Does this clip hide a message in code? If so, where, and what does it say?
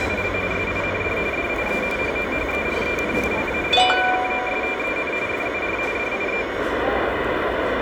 Yes: RTTY (45.45 baud, 170 Hz shift) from 0.0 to 6.6 s, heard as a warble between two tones, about 2300 Hz centre, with radio static and the noise of a restaurant. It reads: … SIND DIE HOHEREN LAGERKOSTEN FUR DIE